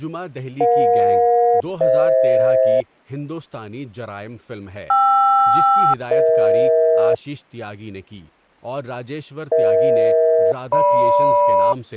Aircraft SELCAL, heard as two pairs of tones, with speech in Urdu. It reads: EJ-FH KR-EH EH-GM